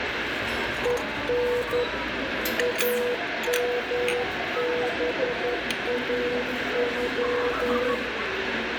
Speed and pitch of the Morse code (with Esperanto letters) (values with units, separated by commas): 11 wpm, 490 Hz